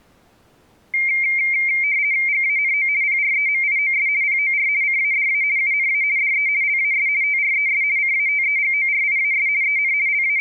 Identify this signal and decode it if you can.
RTTY (50 baud, 170 Hz shift), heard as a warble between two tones, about 2200 Hz centre. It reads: GANO PREMIOS POR CADA UNA DE LAS TRES CATEGORIAS EN …